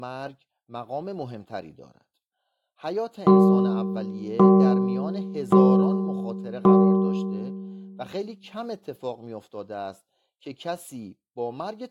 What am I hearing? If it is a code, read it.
Clock strike, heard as a bell, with room echo and speech in Persian. 4. Four o'clock.